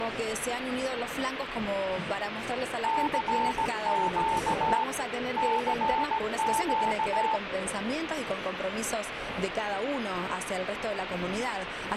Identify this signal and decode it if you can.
Morse code, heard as a keyed tone, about 17 wpm, 890 Hz, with radio static and a weaker station near 420 Hz. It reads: CQ CQ